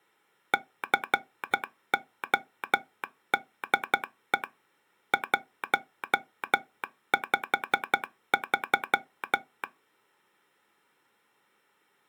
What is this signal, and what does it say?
Morse code, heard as a telegraph sounder, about 12 wpm. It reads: CODE 153